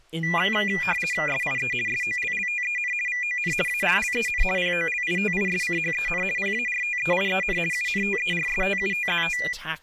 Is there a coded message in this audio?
Yes: RTTY (50 baud, 450 Hz shift) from 0.2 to 9.5 s, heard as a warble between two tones, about 2200 Hz centre, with speech in English. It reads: SIE SOLLTEN VON ALLEN POLITISCHEN PARTEIEN UNTERSTUTZT